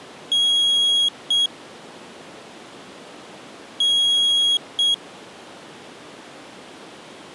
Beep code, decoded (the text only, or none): 1 long, 1 short